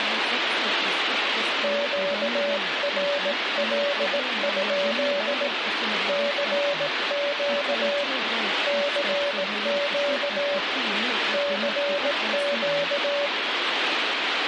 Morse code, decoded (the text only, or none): QRL? CQ CQ CQ